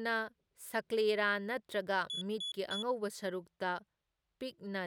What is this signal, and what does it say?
Beep code, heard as a piezo beeper, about 3400 Hz, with speech in Manipuri. 3 short. In AMI BIOS tables: failure in the first 64 KB of memory; in Dell tables: chipset error.